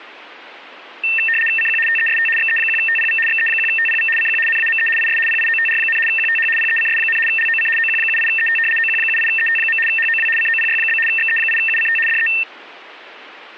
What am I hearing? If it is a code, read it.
RTTY (75 baud, 850 Hz shift), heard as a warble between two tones, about 2250 Hz centre. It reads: CQ TEST XE1TPV XE1TPV CQ NAME IS PIOTR, QTH PECS, LOC OQ78ET OQ78ET. HOW COPY? XE8UCT DE